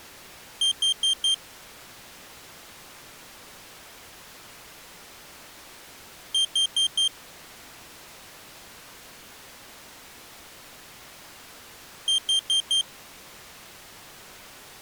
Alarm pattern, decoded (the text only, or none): temporal four